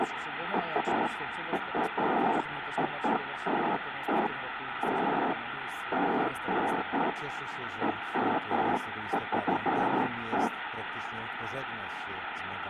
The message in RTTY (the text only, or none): none